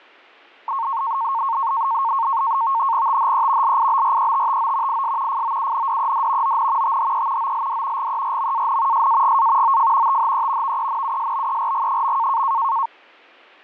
NAVTEX (SITOR-B), 100 baud, 170 Hz shift, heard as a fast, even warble, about 1000 Hz centre. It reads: THE LIBRETTO IS FOUNDED ON THE OLD GERMAN SAGA OF THE VENUSBERG.